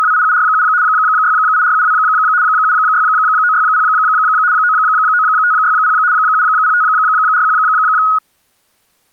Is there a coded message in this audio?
Yes: RTTY (75 baud, 170 Hz shift) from 0.0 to 8.2 s, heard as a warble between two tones, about 1360 Hz centre. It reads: … 68472 76960 99560 70541